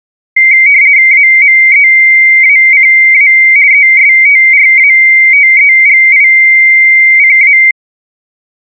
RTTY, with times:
1.1-3.3 AMEACA
3.7-7.6 ESTRATEGICA

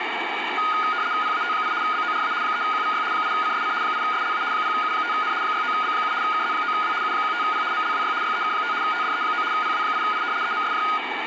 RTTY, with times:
1.2-1.7 PAT8
1.8-2.3 BORA
2.4-3.0 3QVY
3.1-3.7 8CSC
3.8-4.4 8SLA
4.5-5.3 0U5N
5.4-6.1 69B7
6.2-6.9 KZ9W
7.0-7.6 U15P
7.7-8.1 MLWY
8.2-8.7 YEK5
8.8-9.4 TDE9
9.5-10.2 PW8I
10.4-10.8 EMSJ

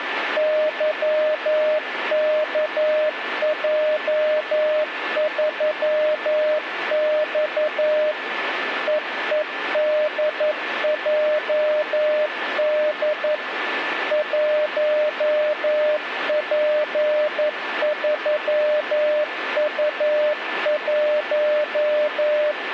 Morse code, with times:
0.4-8.1 YKJ3X
8.9-13.3 EEDJD
14.1-22.5 1P3U1

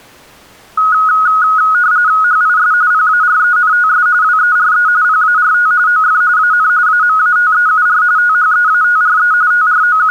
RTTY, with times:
2.2-2.7 HIS
2.9-4.1 PARENTS
4.2-4.9 WERE
5.0-5.7 PART
5.9-6.2 OF
6.4-6.7 AN
6.9-8.0 AMATEUR
8.2-9.3 THEATRE
9.5-10.1 …

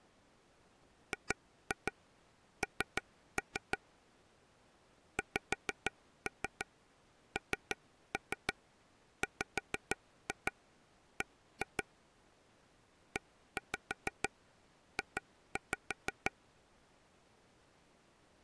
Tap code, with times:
1.1-3.8 GN
5.2-11.8 XNWB
13.2-16.3 EJ

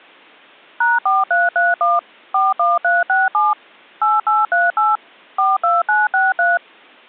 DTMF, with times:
0.8-2.0 #4331
2.3-3.5 41367
4.0-5.0 8838
5.4-6.6 42963

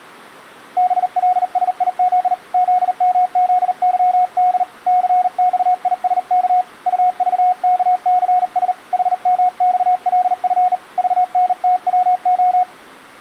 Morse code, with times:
0.8-2.3 BLSIZ
2.5-4.6 ZMZYD
4.9-6.6 CXISK
6.9-8.7 UVKCS
8.9-10.7 HMXLF
11.0-12.6 VNTWO

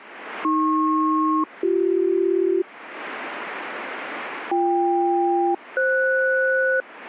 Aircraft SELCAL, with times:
0.4-2.6 AP-BC
4.5-6.8 BK-FS

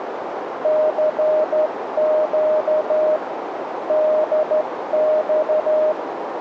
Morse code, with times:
0.6-3.2 CQ
3.9-5.9 DX

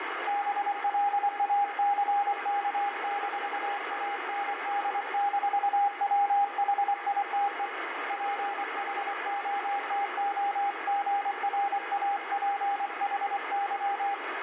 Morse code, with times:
0.3-7.7 BLACK-AND-WHITE
8.1-14.1 PHOTOGRAPHY

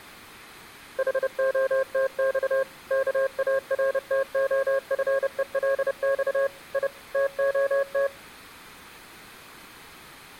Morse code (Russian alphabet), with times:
1.0-2.6 ХОТЬ
2.9-6.5 КАРТОФЕЛЬ
6.7-6.9 И
7.1-8.1 ТОТ

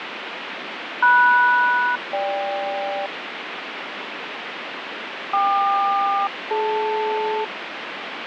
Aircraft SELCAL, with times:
1.0-3.1 MS-GK
5.3-7.4 KQ-DL

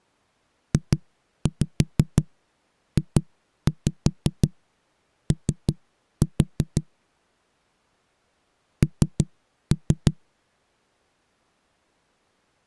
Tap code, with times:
0.7-6.8 JJO
8.8-10.1 N

